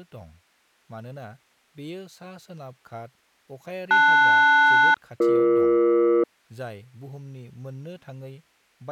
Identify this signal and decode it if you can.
Aircraft SELCAL, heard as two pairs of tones, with speech in Bodo. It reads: LS-BE